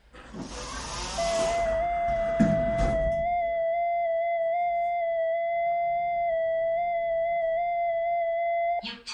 FT8 (one signal), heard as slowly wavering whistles, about 6.25 baud, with room echo and the noise inside a lift.